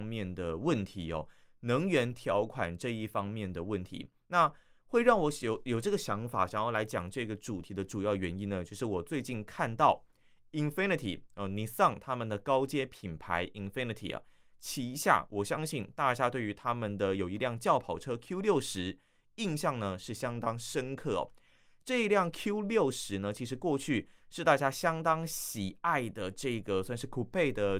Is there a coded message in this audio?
No, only speech in Chinese.